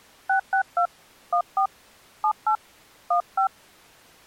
DTMF, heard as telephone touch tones, dialled by hand, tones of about 90 ms. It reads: 662 14 78 15